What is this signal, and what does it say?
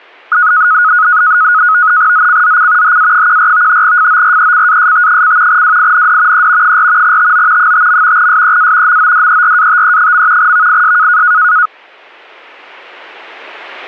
NAVTEX (SITOR-B), 100 baud, 170 Hz shift, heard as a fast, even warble, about 1360 Hz centre. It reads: ZCZC HA14 FORECAST: WIND E 4 TO 5. SEA MODERATE. VIS